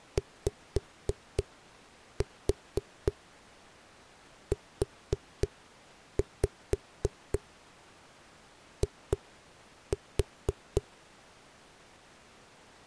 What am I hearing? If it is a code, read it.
Tap code, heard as knocks on a wall, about 4 knocks a second. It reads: YUI